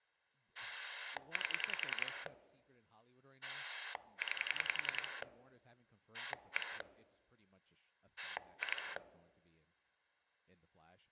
Pulse dialling, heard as a rotary dial, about 10 pulses a second, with speech in English. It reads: 8 9 1 2